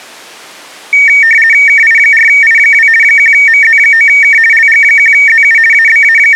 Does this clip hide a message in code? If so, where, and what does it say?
Yes: RTTY (50 baud, 450 Hz shift) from 0.9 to 6.4 s, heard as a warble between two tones, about 2050 Hz centre. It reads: KI4I2 1MZ9K LG1ZU …